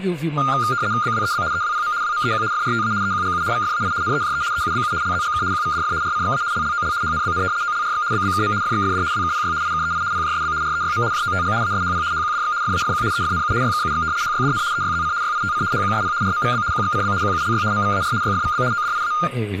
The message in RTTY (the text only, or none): BWEB EWPM WMEQ FRTA EQGU VFAI NEJE EUBU LZGK QVDF RCXA LLOL HNBN OLRX BBKM FXFD WKPY IKEI PJSB REYM JOTG ASHP HQDX FAFQ EFNU YKUX HYDN EYZC YITC HQSP RMVB QXCB QULY MVAR YFVB ODIA